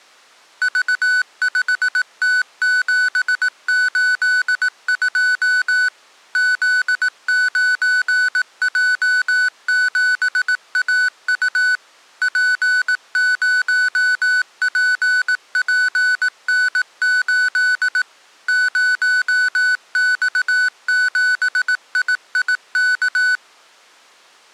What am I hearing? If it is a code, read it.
Morse code, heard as electronic beeps, machine-sent, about 18 wpm, 1500 Hz. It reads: V5T782 Z9J7AU P0PPN8 0X7IIK